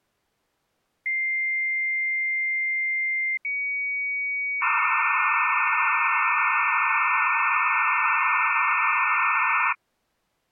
Dial-up modem handshake (low-speed, two carriers), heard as two whistles, then hiss.